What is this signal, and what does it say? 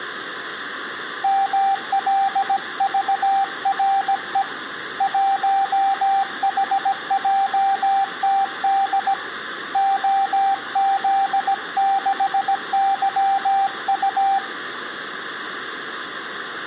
Morse code, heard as a keyed tone, hand-sent with a paddle, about 17 wpm, 780 Hz, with room echo. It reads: MLVRE 1HJTD OZ6YU